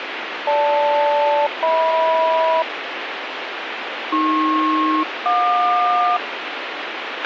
Aircraft SELCAL, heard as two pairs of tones, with radio hiss and a squelch burst at the end. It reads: GL-HM AP-JQ